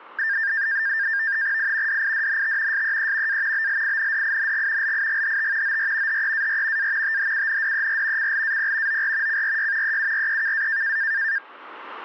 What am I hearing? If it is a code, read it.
NAVTEX (SITOR-B), 100 baud, 170 Hz shift, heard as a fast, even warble, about 1700 Hz centre. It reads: I DIDNT SEE A BLINDING LIGHT OR HEAR A THUNDER CLAP OR CRY EUREKA